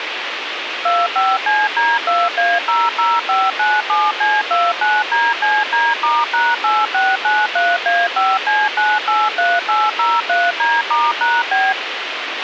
DTMF, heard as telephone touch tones, dialled by machine, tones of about 210 ms, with radio hiss and a squelch burst at the end. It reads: 25CD2A00597C29DCD*#8693A5C983803D*#B